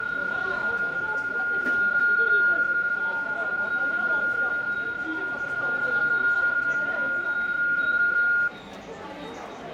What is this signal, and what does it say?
PSK31 (31.25 baud), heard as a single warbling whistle, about 1420 Hz, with fading, room echo and the noise of a subway station.